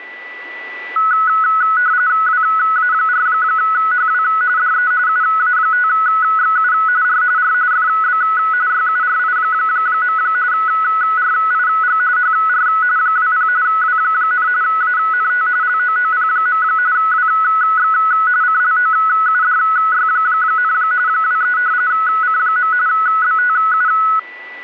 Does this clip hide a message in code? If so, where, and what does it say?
Yes: RTTY (45.45 baud, 170 Hz shift) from 1.0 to 24.2 s, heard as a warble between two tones, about 1380 Hz centre, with a steady whistle near 1970 Hz. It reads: WA4HW DE UA5XU R R FB YURI. RIG HR 20 W, ANT LOOP. WX CLOUDY, 23 C. BTU